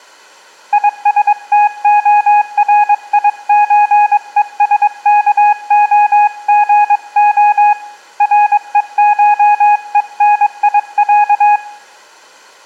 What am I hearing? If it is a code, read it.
Morse code (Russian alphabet), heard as a keyed tone, hand-sent with a paddle, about 22 wpm, 830 Hz, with room echo. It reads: ИСТОРИЧЕСКОГО РЕШЕНИЯ